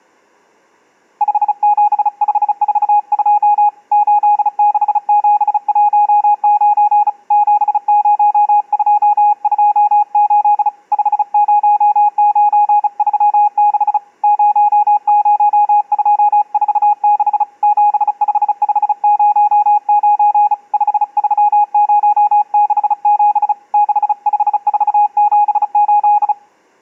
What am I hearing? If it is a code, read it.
Morse code, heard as a keyed tone, hand-sent with a bug key, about 35 wpm, 830 Hz. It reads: 57542 86719 70228 50936 00246 75509 53067 65478